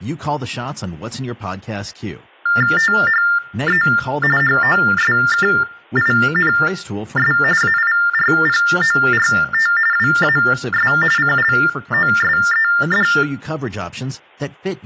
TTY/TDD text telephone tones (45.45 baud Baudot), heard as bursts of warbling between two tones, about 400 Hz shift, 1600 Hz centre, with room echo and speech in English. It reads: THE HOSKINS AIRPORT WAS CLOSED